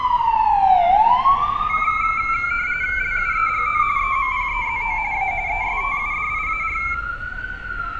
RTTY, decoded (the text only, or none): LUEGO EMPEZO A ESTUDIAR